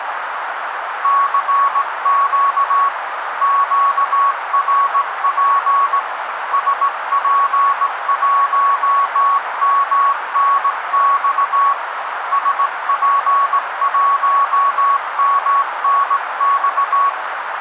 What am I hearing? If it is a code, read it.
Morse code, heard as a keyed tone, hand-sent with a straight key, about 18 wpm, 1120 Hz, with radio static and a narrow filter. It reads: CQ QRP SP1MNX SP1MNX